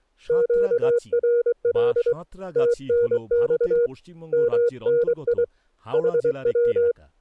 Morse code, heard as a keyed tone, hand-sent with a straight key, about 23 wpm, 480 Hz, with speech in Bangla. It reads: QRL TNX MNI HW